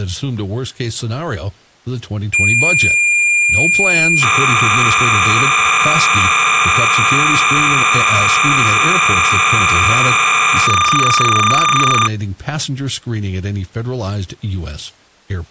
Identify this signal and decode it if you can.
Cassette data (Kansas City type), 300 baud, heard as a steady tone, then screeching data, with speech in English.